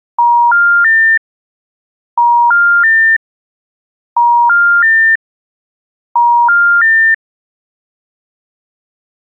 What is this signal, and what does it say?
Telephone call progress tone (ITU plan), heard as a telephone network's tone, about 950, 1400, 1800 Hz. Special information tone.